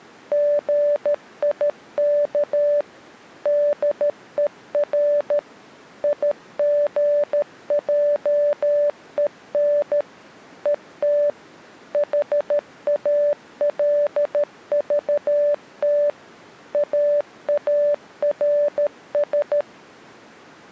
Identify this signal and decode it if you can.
Morse code, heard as a keyed tone, machine-sent, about 13 wpm, 580 Hz. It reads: GIK DER IGJEN ET HALVT AARS